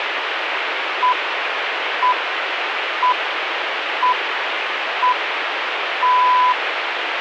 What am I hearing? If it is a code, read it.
Radio time signal (six pips, as the Greenwich Time Signal), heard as pips, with radio static.